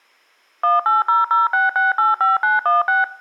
DTMF, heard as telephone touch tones, dialled by machine, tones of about 160 ms. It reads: 18006685916